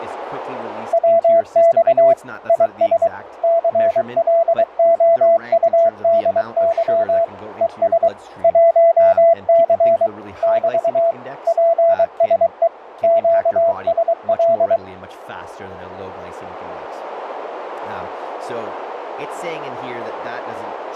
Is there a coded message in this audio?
Yes: Morse code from 0.9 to 14.8 s, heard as a keyed tone, machine-sent, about 23 wpm, 670 Hz, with radio static and speech in English. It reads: WX IS CLOUDY ES 1C <BT> PSE QSL